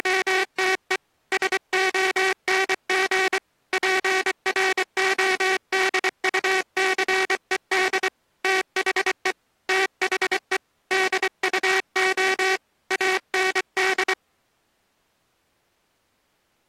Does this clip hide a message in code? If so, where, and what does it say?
Yes: Morse code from 0.0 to 14.2 s, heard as a buzzer, hand-sent with a paddle, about 24 wpm. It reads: … SONG PRODUCED THE THE DUO AND